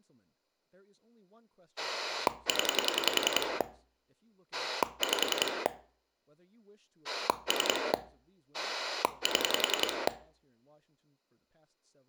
Pulse dialling, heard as a rotary dial, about 10 pulses a second, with speech in English. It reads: 0 5 3 7